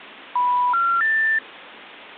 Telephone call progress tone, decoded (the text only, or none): special information tone